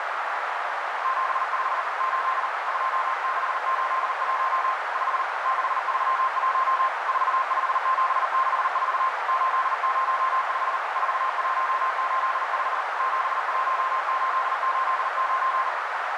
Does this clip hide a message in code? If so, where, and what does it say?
Yes: Morse code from 1.0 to 15.7 s, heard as a keyed tone, hand-sent with a paddle, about 39 wpm, 1050 Hz, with heavy radio static and a narrow filter. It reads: 75 8 2681 5 631 45764 805 4185 71889